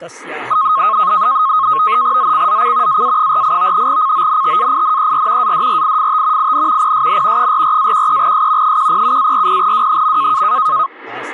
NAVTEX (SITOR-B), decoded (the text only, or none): ZCZC AA48 CONTAINER ADRIFT IN PSN 44-13S 107-40W.